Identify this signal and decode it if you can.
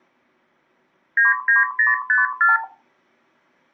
Multi-frequency trunk signalling (R2, with the far end's replies), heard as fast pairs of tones, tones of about 160 ms. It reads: 99054